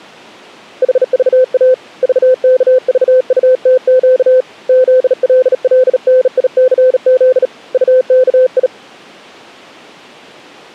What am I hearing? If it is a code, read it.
Morse code, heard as a keyed tone, hand-sent with a bug key, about 37 wpm, 510 Hz. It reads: HVA VKVUTQ ZLLNICZ UKI